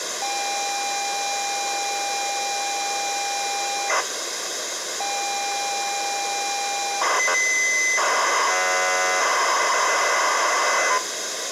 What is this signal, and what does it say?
ZX Spectrum tape loading, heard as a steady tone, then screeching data, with tape hiss.